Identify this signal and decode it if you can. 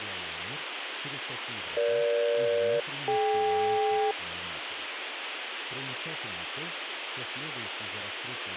Aircraft SELCAL, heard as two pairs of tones, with radio hiss. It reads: EG-DK